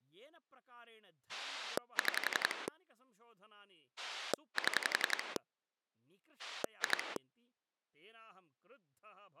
Pulse dialling, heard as a rotary dial, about 11 pulses a second, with speech in Sanskrit. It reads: 6 7 2